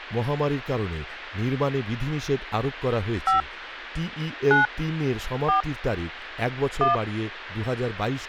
DTMF, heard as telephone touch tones, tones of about 140 ms, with speech in Bangla. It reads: 5 9 4 1